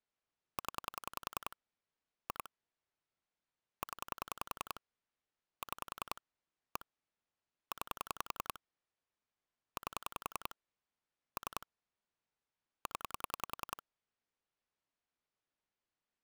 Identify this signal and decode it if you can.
Pulse dialling, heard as clicks on a phone line, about 10 pulses a second. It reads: 0 2 0 6 1 9 8 3 0